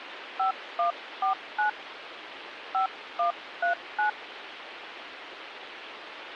DTMF, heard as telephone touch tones, dialled by hand, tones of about 120 ms, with phone line noise. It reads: 5149 5139